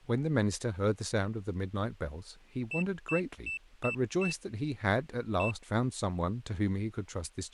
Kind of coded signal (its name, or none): beep code